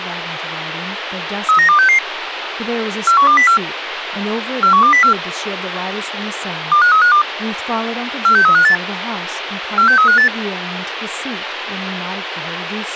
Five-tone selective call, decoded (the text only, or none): 39266 41204 41204 25352 46358 46358